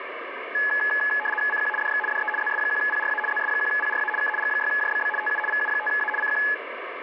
RTTY (75 baud, 850 Hz shift), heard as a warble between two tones, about 1280 Hz centre, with radio static. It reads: CQ DX DE ZS1PRA ZS1PRA K G6JBB TU VU5A CQ